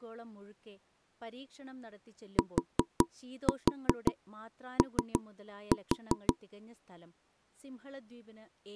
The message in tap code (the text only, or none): TO